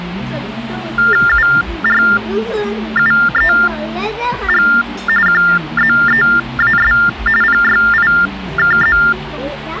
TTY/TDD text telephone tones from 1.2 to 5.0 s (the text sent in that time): URUEG